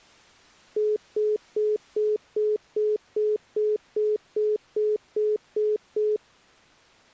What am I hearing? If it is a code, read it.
Telephone call progress tone (single-tone plan, as in most of Europe), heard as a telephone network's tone, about 420 Hz, 0.2 s on and 0.2 s off. Congestion tone.